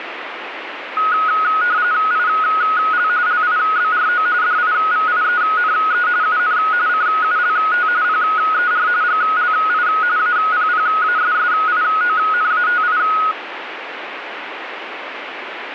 RTTY (45.45 baud, 170 Hz shift), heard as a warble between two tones, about 1360 Hz centre, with radio static. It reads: IL LIBRO DIVIENE UN CULT PER GLI APPASSIONATI